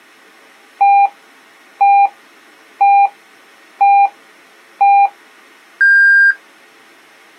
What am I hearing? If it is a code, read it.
Radio time signal (five pips and a higher one, as on Chinese radio), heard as pips.